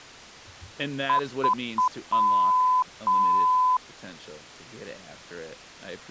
Beep code, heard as beeps, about 1010 Hz, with speech in English. 3 short, 2 long.